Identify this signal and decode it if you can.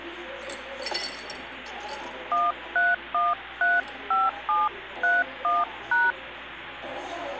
DTMF, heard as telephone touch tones, dialled by hand, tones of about 190 ms, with phone line noise and the noise of a cafe. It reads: 13135731#